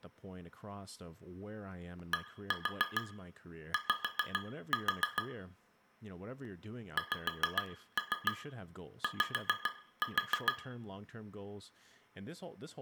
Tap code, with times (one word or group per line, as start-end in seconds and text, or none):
2.1-5.2 DY
7.0-10.5 XY